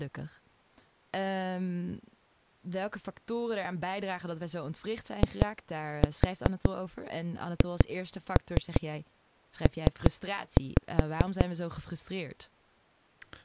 Tap code, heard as knocks on a wall, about 5 knocks a second, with speech in Dutch. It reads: IHP